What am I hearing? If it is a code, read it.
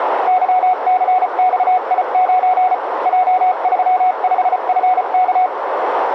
Morse code, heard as a keyed tone, machine-sent, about 34 wpm, spaced as for 31 wpm, 740 Hz, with radio static, a narrow filter and room echo. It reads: YCXI9 J35FK